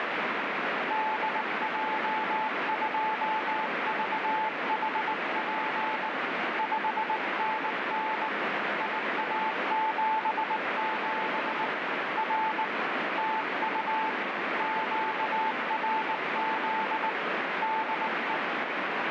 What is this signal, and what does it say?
Morse code, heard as a keyed tone, hand-sent with a bug key, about 19 wpm, 880 Hz, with heavy radio static. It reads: DJ2VHP 5NN IA77 R TU QRZ DE